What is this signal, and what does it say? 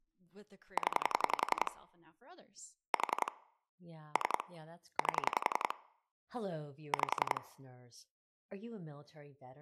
Pulse dialling, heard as clicks on a phone line, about 11 pulses a second, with speech in English. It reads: 0 4 3 8 5